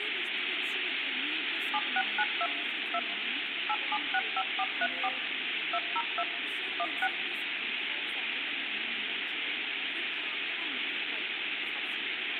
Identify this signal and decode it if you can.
DTMF, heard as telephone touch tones, dialled by machine, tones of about 50 ms, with phone line noise and speech in Bodo. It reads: 7692 2 8765434 202 16